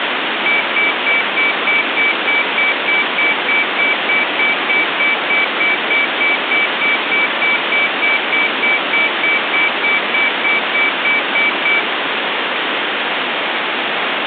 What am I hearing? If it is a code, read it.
Evenly repeated beeps, with phone line noise. There is no code.